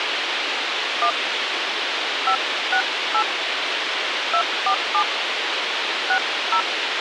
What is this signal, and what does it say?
DTMF, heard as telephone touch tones, dialled by hand, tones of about 80 ms, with radio hiss. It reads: 1 568 247 60